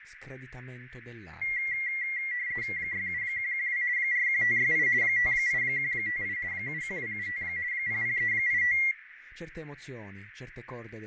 RTTY (50 baud, 170 Hz shift), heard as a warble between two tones, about 2050 Hz centre, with radio static, fading, a narrow filter and speech in Italian. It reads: 67112 41568 58158 71275 00385